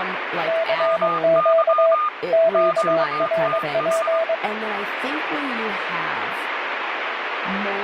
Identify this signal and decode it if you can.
Morse code, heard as two keyed tones, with radio static and speech in English. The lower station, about 22 wpm, 660 Hz: CQ QRP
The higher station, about 22 wpm, 1220 Hz: MY QTH